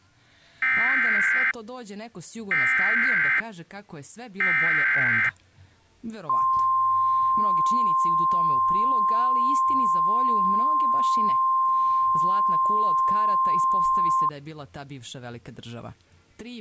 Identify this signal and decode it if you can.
Emergency Alert System (SAME) tones (header bursts, then the 1050 Hz attention tone), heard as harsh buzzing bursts, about 520.83 baud.